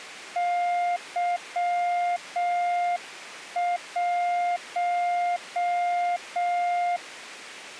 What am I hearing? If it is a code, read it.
Morse code, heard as a keyed tone, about 6 wpm, 700 Hz. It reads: Y1